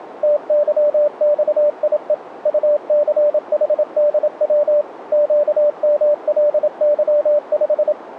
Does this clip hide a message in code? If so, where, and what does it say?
Yes: Morse code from 0.2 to 8.0 s, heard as a keyed tone, machine-sent, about 27 wpm, 590 Hz, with radio static. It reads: TYXIE UCHDW QMLY5